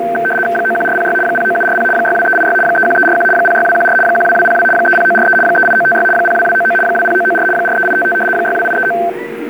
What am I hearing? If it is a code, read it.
RTTY (75 baud, 850 Hz shift), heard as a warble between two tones, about 1110 Hz centre, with a steady whistle near 470 Hz and the noise of a park. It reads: 91406 09740 62386 31341 06214 12202 30943 38956 02299 20994 43855 62839